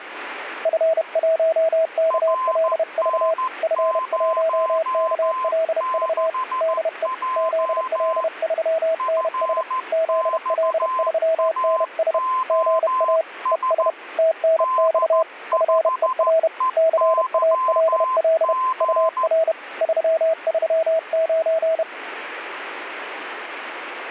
Morse code, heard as two keyed tones, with radio static. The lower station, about 31 wpm, 650 Hz: F1KLV F1KLV DE ZL3NS ZL3NS GA ES TNX FER CALL UR 339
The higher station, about 14 wpm, 1030 Hz: RN06J FXAOS D5EYG